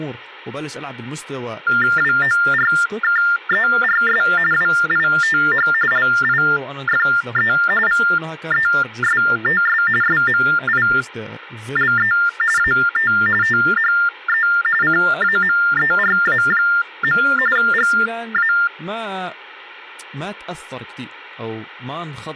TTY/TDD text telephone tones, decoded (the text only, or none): WORKERS WITH LIFE VESTS SMILE AT THE CAMERA. GA